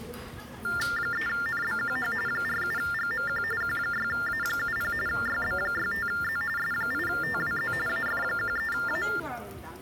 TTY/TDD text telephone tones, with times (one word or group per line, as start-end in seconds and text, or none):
1.0-2.1 3NBQH
2.3-3.4 47GMQ
3.6-4.9 Q6A70
5.1-6.4 YB65Z
6.6-7.7 S8TWZ
7.9-9.0 AF13A